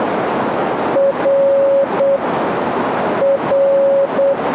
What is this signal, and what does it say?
Morse code, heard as a keyed tone, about 8 wpm, 550 Hz, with radio static and a narrow filter. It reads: R R